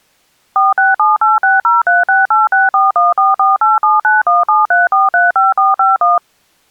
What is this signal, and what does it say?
DTMF, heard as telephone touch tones, dialled by machine, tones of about 170 ms. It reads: 46786036864144879173435451